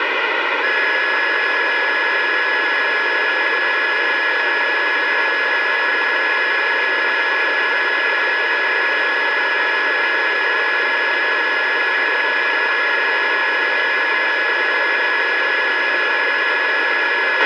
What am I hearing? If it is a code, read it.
A steady tone, with radio hiss and a squelch burst at the end. There is no code.